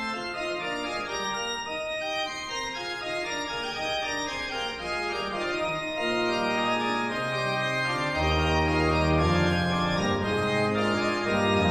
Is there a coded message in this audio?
No.